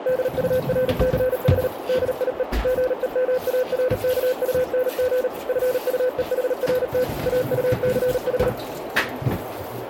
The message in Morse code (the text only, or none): DURCH DIE GEMARKUNG FUEHRT AUCH